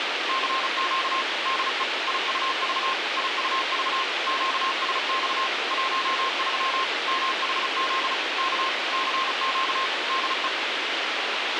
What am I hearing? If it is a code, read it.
Morse code, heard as a keyed tone, machine-sent, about 35 wpm, 1060 Hz, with radio hiss and a squelch burst at the end. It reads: CQ DE IUV IUV QSX 13 MHZ K CQ DE